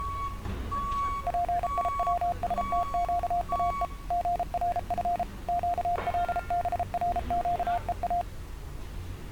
Morse code (Persian alphabet), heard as a keyed tone, machine-sent, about 33 wpm, 700 Hz, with street noise. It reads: پیوستگاه ژرف گلبرگها